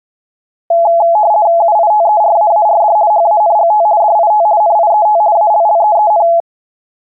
RTTY (50 baud, 170 Hz shift), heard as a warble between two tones, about 760 Hz centre. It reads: UITERAARD HANGT DIT NIET ALLEEN